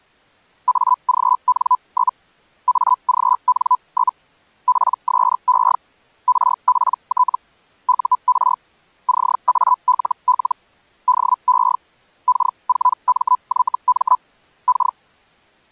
Hellschreiber (Feld-Hell, 122.5 baud), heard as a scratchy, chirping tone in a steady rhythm, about 1000 Hz. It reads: AGN? AGN? PSE RPT UR CALL DE K4MYM K